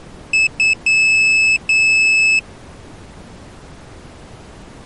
Beep code, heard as a piezo beeper, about 2600 Hz. 2 short, 2 long.